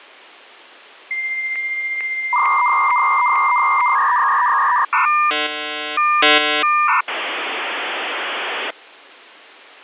Dial-up modem handshake (V.34 or later), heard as a whistle, warbles, then hiss.